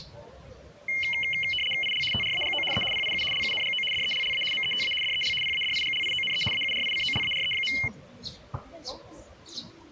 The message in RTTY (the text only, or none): IL TRAGO E PIU LUNGO DELLA META DEL PADIGLIONE AURICOLARE.